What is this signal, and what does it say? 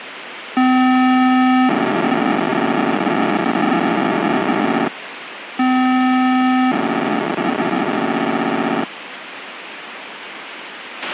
POCSAG pager data (512 baud), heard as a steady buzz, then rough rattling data, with radio hiss and a squelch burst at the end.